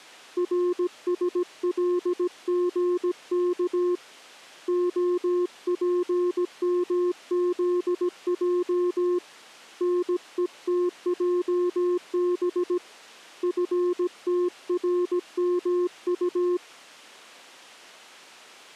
Morse code, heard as a keyed tone, hand-sent with a paddle, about 17 wpm, 360 Hz. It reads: RSLGK OPMZJ NETJB FTRMU